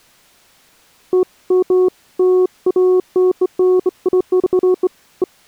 Beeps of irregular length. There is no code.